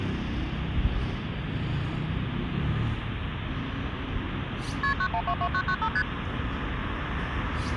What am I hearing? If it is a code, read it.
Multi-frequency trunk signalling (R1, as on North American trunks), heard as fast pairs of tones, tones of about 70 ms, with phone line noise and street noise. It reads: KP 9122995 ST